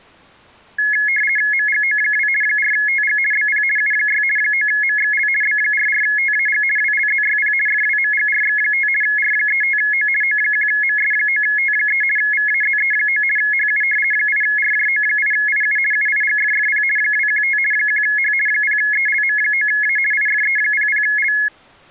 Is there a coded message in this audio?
Yes: RTTY (50 baud, 450 Hz shift) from 0.8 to 21.5 s, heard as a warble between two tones, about 1900 Hz centre. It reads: MGO2 4TG BP U6 9MXL B44TAG WLZYP FWMGRX5 R35O O1MS9T3 VAZE9 HU 8RJO8IU UIGFFP 215 1H 0ELM9A IFE00L